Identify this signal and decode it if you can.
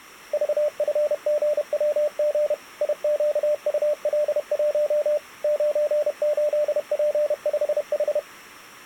Morse code, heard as a keyed tone, machine-sent, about 31 wpm, 600 Hz. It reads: VFGWG IQUL1 98P5H